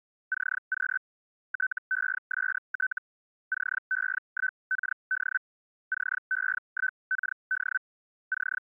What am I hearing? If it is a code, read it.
Hellschreiber (Feld-Hell, 122.5 baud), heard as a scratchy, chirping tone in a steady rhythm, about 1500 Hz. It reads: CQ TEST CE1KD CE1KD …